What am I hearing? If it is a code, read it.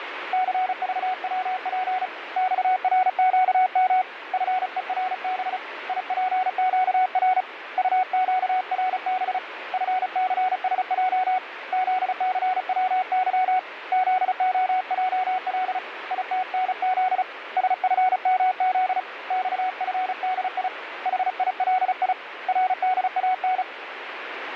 Morse code, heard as a keyed tone, hand-sent with a paddle, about 35 wpm, 740 Hz, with radio static. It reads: CVWP XRQM FERB IPQR UQRB FCSJ ZCWY ZOJL ITNZ SFMZ XFDI HILI RDAN